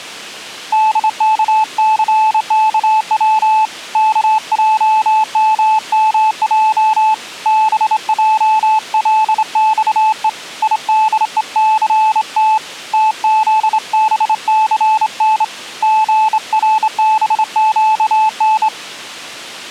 Morse code, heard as a keyed tone, hand-sent with a straight key, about 26 wpm, 870 Hz. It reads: DKCKW KJMMJ BJLXE IDECT TZBCN GRBQN